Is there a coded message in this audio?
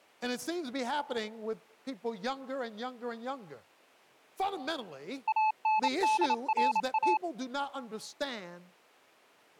Yes: Morse code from 5.2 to 7.2 s, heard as a keyed tone, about 28 wpm, 860 Hz. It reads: ANDRA